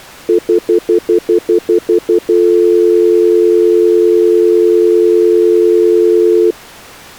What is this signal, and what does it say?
Telephone call progress tone (North American plan), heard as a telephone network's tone, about 350, 440 Hz, 0.1 s on and 0.1 s off. Stutter dial tone.